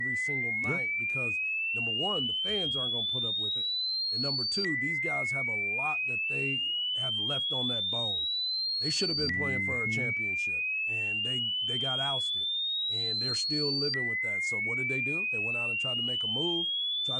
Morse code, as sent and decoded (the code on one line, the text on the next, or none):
none